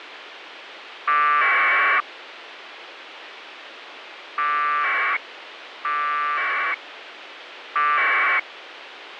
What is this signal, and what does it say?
Packet radio (AX.25, as in APRS), 1200 baud, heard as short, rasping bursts, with radio hiss and a squelch burst at the end.